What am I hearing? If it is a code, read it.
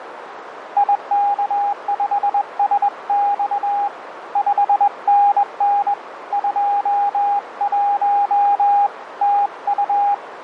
Morse code, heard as a keyed tone, hand-sent with a straight key, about 21 wpm, 810 Hz, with radio static and a narrow filter. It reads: IK5SX 5NN 21 TU